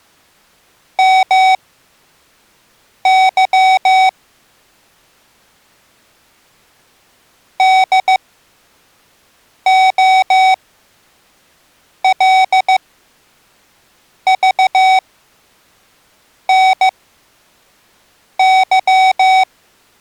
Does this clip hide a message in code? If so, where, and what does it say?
Yes: Morse code (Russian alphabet) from 0.9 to 19.5 s, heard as electronic beeps, machine-sent, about 15 wpm, spaced as for 5 wpm, 760 Hz. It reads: МЫ ДОЛЖНЫ